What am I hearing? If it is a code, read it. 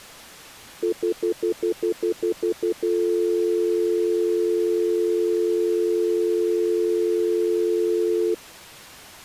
Telephone call progress tone (North American plan), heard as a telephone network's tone, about 350, 440 Hz, 0.1 s on and 0.1 s off. Stutter dial tone.